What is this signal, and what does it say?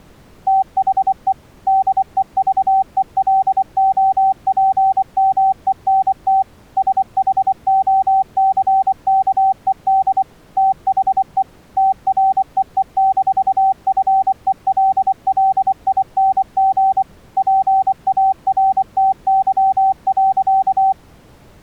Morse code, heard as a keyed tone, machine-sent, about 24 wpm, 770 Hz. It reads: THE DEVELOPMENT SHOCKED THE TREE-FELLING PARTY.